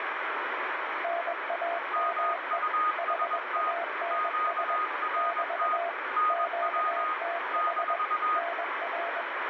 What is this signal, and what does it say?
Morse code, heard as two keyed tones, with heavy radio static. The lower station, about 21 wpm, 680 Hz: NAME HANS <BT> QTH NR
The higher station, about 21 wpm, 1240 Hz: MUST QRT NW -